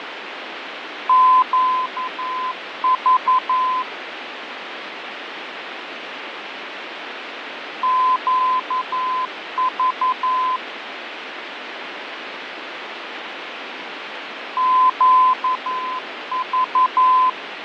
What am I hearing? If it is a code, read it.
Morse code, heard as a keyed tone, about 11 wpm, 1020 Hz, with radio static and fading. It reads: QV QV QV